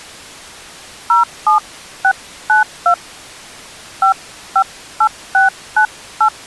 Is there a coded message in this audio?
Yes: DTMF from 1.1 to 6.3 s, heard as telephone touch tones, dialled by hand, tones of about 110 ms. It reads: 07692 558698